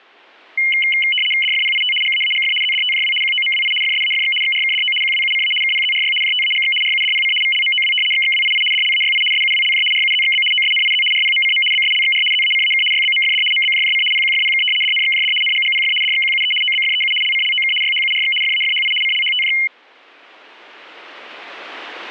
RTTY (75 baud, 850 Hz shift), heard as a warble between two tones, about 2550 Hz centre. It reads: DFPIT GAAGF ZDTJW QOMWI FSAFX XRKDO QWUCA KPZRY JTAGX RUDPC VLMOW XXWII DLAYI SUWLJ RUZXB OSNIZ RPMCM BSLXR ZACAK YBMFD MBJJC PQFPK DNXJD NGGPF DXQUE OBFEU LCLOK YHURX FAFHI CLHTJ